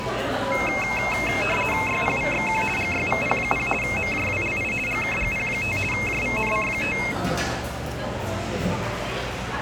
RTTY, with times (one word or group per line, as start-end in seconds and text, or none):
1.9-2.6 YPVXQ
2.8-3.7 GYVP0
3.8-4.7 MJWLI
4.9-5.8 GKGP5
5.9-7.0 JVNC5